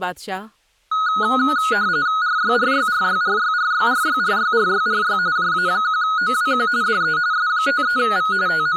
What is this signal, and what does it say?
RTTY (45.45 baud, 170 Hz shift), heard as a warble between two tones, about 1360 Hz centre, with speech in Urdu. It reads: RYRYRYRYRYRYRYRYRY JA1OWQ DE S53V …